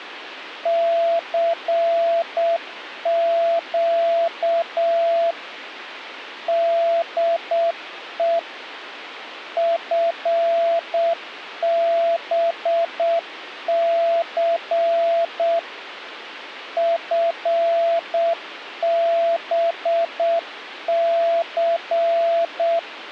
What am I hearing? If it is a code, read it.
Morse code, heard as a keyed tone, machine-sent, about 7 wpm, 670 Hz, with radio hiss and a squelch burst at the end. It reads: CQ DE FBC FBC